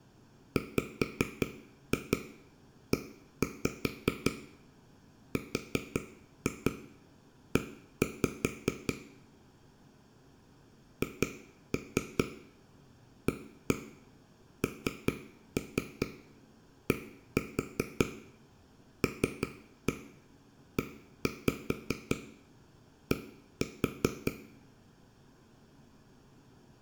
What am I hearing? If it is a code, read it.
Tap code, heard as taps on a table, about 5 knocks a second, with room echo. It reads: WERE HANDLED